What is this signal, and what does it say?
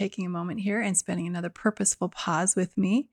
Speech in English. There is no code.